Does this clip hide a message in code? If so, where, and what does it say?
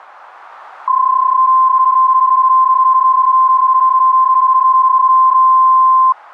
Yes: PSK31 (31.25 baud) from 0.9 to 6.1 s, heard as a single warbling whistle, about 1040 Hz.